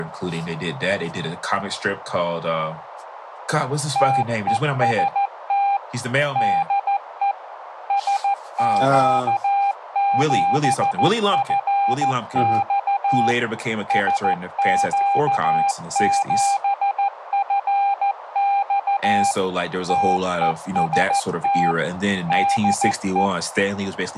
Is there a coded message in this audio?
Yes: Morse code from 3.9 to 23.3 s, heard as a keyed tone, machine-sent, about 14 wpm, 800 Hz, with radio static and speech in English. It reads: TEST DE SQ7FX SQ7FX TEST DE